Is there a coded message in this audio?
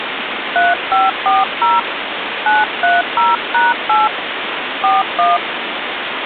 Yes: DTMF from 0.6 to 5.4 s, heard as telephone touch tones, dialled by hand, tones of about 180 ms, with phone line noise. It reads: 3540 930#8 41